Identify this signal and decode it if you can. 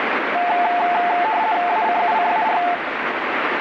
RTTY (50 baud, 170 Hz shift), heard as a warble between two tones, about 790 Hz centre, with radio static. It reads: ACUCAR